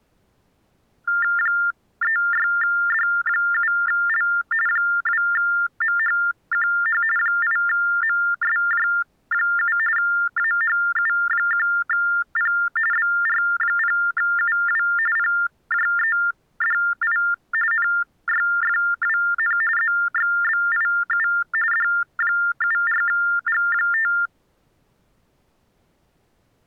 TTY/TDD text telephone tones (45.45 baud Baudot), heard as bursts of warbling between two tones, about 400 Hz shift, 1600 Hz centre. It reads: 36D7L 2MHQH 8MSJ7 AHU1P BR0UW PJEDI NYFWN ZXBIU D74G5